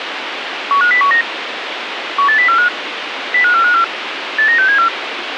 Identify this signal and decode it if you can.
Five-tone selective call (CCIR), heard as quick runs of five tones, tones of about 100 ms, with radio hiss. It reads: 15019 18045 05454 89674